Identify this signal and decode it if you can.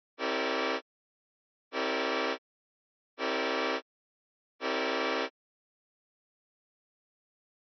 Train horn signal, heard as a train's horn. 4 short. On North American railways: a request for a signal to be given or repeated.